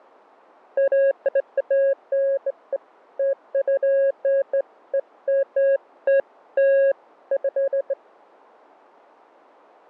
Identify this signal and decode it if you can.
Beeps of irregular length, with fading. There is no code.